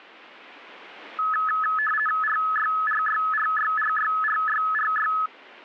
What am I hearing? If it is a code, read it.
RTTY (50 baud, 450 Hz shift), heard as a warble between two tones, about 1500 Hz centre. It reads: RYRYRYRYRYRY